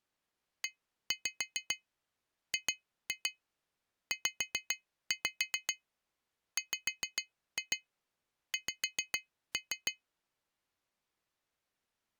Tap code, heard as taps on glass, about 7 knocks a second. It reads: EGZWX